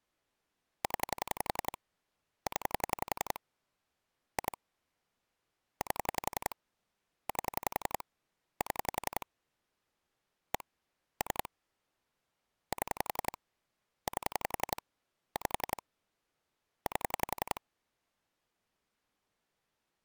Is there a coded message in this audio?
Yes: pulse dialling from 0.8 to 17.6 s, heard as clicks on a phone line, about 11 pulses a second. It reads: 0 0 2 8 8 7 1 3 7 8 5 8